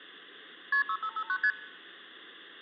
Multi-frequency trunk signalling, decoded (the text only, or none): KP 6559 ST